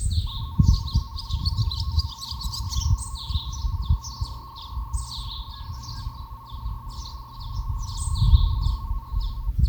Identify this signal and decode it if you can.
NAVTEX (SITOR-B), 100 baud, 170 Hz shift, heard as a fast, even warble, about 1000 Hz centre, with the noise of a park. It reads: ATRBA BAWKO GTUEI GUSTH SGPZM LQEDM LGYLD KYCAQ